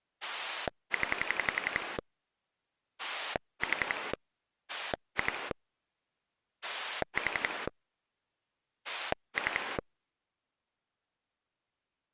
Pulse dialling, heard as a rotary dial, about 11 pulses a second. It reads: 0 4 2 4 3